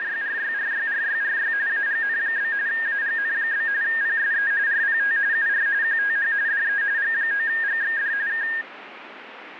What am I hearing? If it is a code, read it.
RTTY (45.45 baud, 170 Hz shift), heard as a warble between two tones, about 1750 Hz centre, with radio static. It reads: … AGN? AGN? PSE RPT UR QTH DE G9GXD K